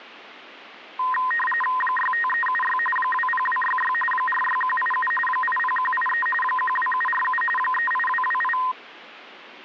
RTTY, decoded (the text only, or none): 65376 20266 46187 80183 12747 38228